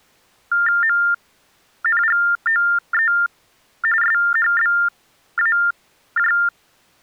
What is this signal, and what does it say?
TTY/TDD text telephone tones (45.45 baud Baudot), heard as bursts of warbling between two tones, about 400 Hz shift, 1600 Hz centre. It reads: MNGOE SHBAJ